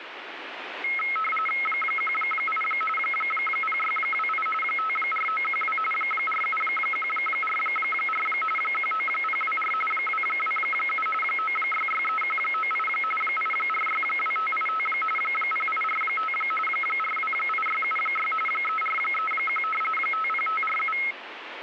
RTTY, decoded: 18 0628 54912 47144 19024 227 9663198 8462585 0845 428676 3431 50547

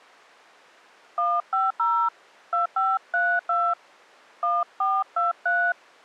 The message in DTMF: 150 2532 1423

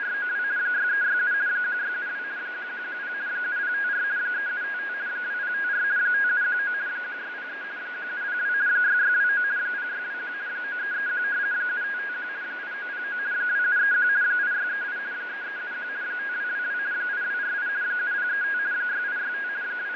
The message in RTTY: … 6367 1672 1110 7054 3755 2054 5719 1603 1702 6629 0621 9331 7551 8909 2731 8638 3371 5222 8248 7035 6865 …

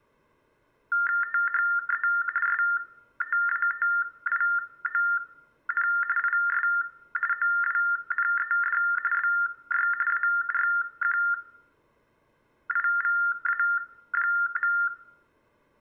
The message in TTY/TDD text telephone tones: THE STATION IS OWNED BY ARQIVA.

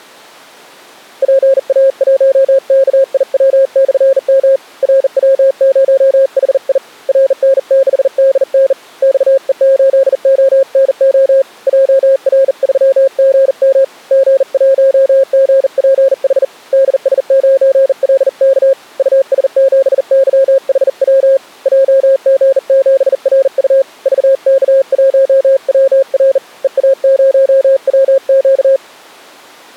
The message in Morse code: PA1KIW/M RW0HI RN6DN XE8ONO JR3GM G1GPH DS9LK US7YHW JG7RU VK1WR EA0WQ

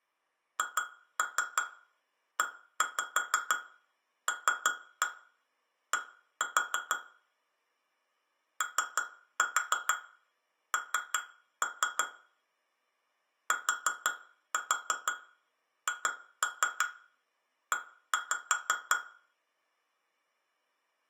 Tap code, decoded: HELD ON THE

